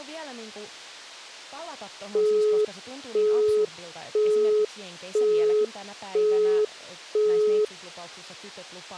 Telephone call progress tone (single-tone plan, as in Europe, Japan and elsewhere), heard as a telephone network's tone, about 420 Hz, 0.5 s on and 0.5 s off, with speech in Finnish. Busy tone.